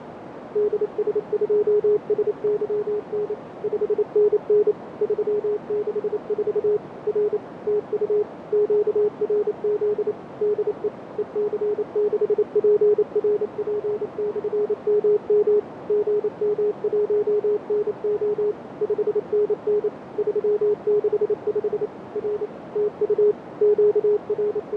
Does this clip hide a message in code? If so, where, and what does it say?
Yes: Morse code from 0.5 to 24.8 s, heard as a keyed tone, machine-sent, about 28 wpm, 420 Hz, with radio static, fading and a narrow filter. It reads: DS2SYN 5NN 364 R TU QRZ DE EC6PRP/MM GM1NO 5NN 365 R TU …